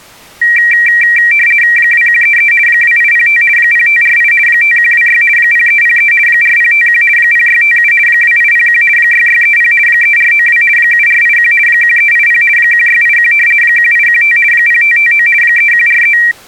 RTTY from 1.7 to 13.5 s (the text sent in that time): 2133 2805 0548 5126 0303 4051 0657 2801 6630 3492 7481 1380 1681